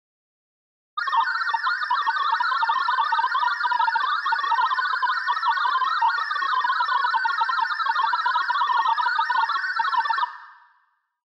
Multi-tone FSK (Olivia or MFSK type), about 1000 Hz wide, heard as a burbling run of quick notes, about 62.5 baud, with room echo.